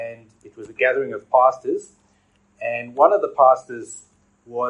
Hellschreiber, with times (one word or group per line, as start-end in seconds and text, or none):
none